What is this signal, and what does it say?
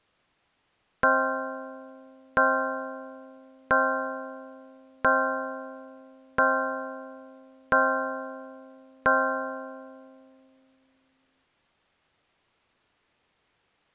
Clock strike, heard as a bell. 7. Seven o'clock.